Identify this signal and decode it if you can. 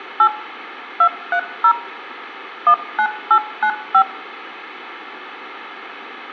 DTMF, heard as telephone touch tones, dialled by machine, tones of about 80 ms, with room echo. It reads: 8 230 19895